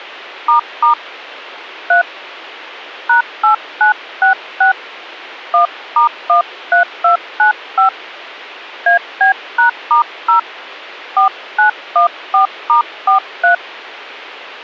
DTMF, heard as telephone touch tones, dialled by hand, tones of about 120 ms. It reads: ** 3 #8966 1*13295 AB#*0 4914*43